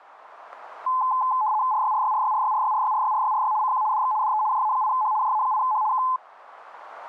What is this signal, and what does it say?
RTTY (75 baud, 170 Hz shift), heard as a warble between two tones, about 940 Hz centre, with static crashes. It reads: RYRYRYRYRYRYRYRYRY CQ DX DE JA8H JA8H K